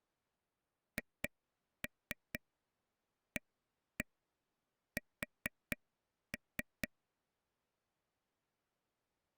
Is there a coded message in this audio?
Yes: tap code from 1.0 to 6.9 s, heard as taps on a table, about 4 knocks a second. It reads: HAS